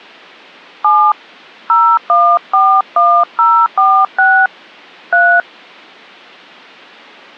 DTMF, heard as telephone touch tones, dialled by hand, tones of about 270 ms. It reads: 7 0141046 3